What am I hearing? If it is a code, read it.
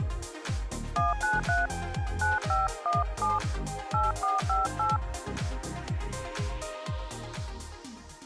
DTMF, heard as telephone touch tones, dialled by hand, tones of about 170 ms. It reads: 193 9517 8458